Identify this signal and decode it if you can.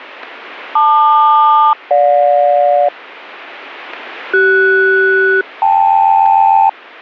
Aircraft SELCAL, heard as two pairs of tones. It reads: LQ-GJ CS-KL